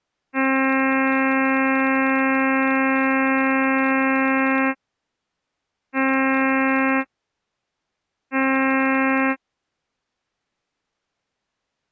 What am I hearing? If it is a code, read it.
Ship horn signal, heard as a ship's horn, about 270 Hz. 1 long, 2 short. At sea: a vessel in fog that is sailing, fishing, towing or hampered.